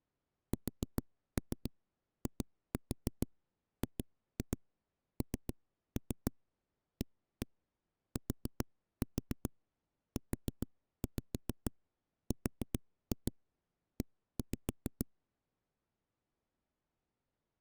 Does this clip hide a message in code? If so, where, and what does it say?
Yes: tap code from 0.5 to 15.0 s, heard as knocks on a wall, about 7 knocks a second. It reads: SIGNATURE